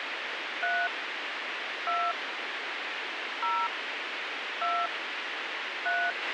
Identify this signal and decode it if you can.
DTMF, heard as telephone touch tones, dialled by hand, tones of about 240 ms, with radio hiss and a squelch burst at the end. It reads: 3 2 0 2 3